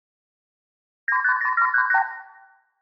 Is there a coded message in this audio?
Yes: multi-frequency trunk signalling (R2, with the far end's replies) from 1.1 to 2.0 s, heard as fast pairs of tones, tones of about 80 ms, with room echo. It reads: 950738